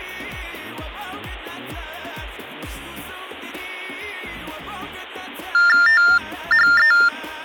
TTY/TDD text telephone tones (45.45 baud Baudot), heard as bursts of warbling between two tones, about 400 Hz shift, 1600 Hz centre. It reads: THE